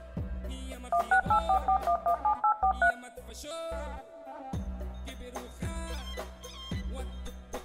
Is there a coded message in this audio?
Yes: DTMF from 0.9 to 2.9 s, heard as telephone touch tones, dialled by machine, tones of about 90 ms, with room echo. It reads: 16844117843